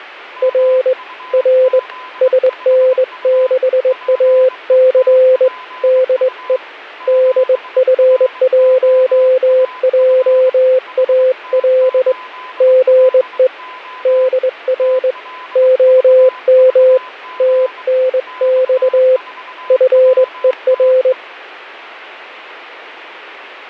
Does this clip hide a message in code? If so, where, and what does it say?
Yes: Morse code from 0.4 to 21.2 s, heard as a keyed tone, hand-sent with a straight key, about 21 wpm, 520 Hz, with a weaker station near 1010 Hz. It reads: R R SN6AC DE DF1JAL GE DR OM TNX FER